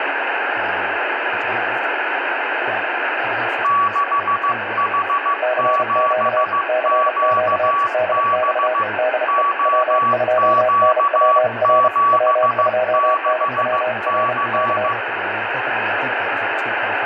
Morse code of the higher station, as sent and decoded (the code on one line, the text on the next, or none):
-.... .... --... --.- -... / --- --.- --... -.... -.-.
6H7QB OQ76C